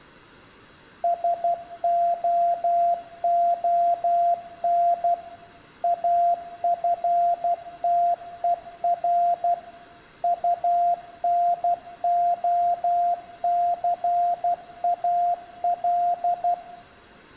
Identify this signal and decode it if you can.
Morse code, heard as a keyed tone, machine-sent, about 12 wpm, 700 Hz, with room echo. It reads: SOON AFTER UNOCAL